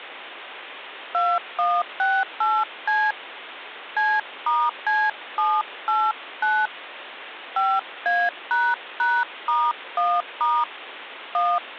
DTMF, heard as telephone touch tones, dialled by hand, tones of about 230 ms, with phone line noise. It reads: 2168C C*C789 5A##*1* 1